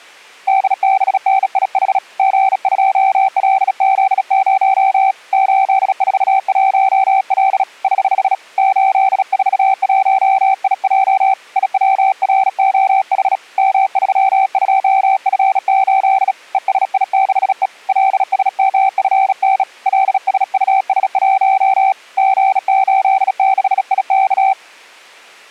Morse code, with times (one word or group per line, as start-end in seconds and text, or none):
0.5-2.0 DBNIH
2.2-5.1 G2LZ0
5.3-7.6 841L
7.8-8.3 <HH>
8.6-11.3 841IJ
11.6-13.4 IWROH
13.6-16.3 M32F8
16.5-17.7 ESI6E
17.9-19.6 LSMFN
19.9-21.9 LSUS1
22.2-24.5 G86IK